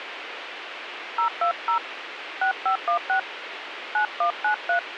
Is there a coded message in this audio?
Yes: DTMF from 1.2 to 4.8 s, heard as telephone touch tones, dialled by hand, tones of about 100 ms, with radio hiss and a squelch burst at the end. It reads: 020 6516 9193